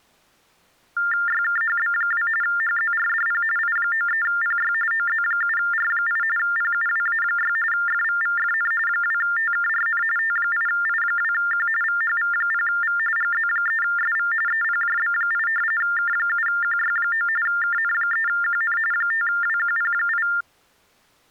TTY/TDD text telephone tones (45.45 baud Baudot), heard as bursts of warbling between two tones, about 400 Hz shift, 1600 Hz centre. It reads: YKHB2 HZRDP I93PY OZ7R8 PUWA6 FVVFN 2TKRN T8I2Q VHV0V GZ3SV EPJB8 K7QY9 KN3QN 5WQP8